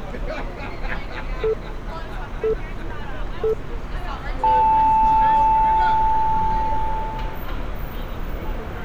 Radio time signal (three low pips and a long one an octave up, as on NHK), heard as pips, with street noise.